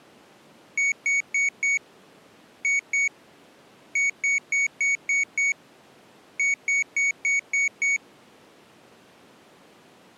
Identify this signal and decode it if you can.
Beep code, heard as a piezo beeper, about 2250 Hz. 4-2-6-6.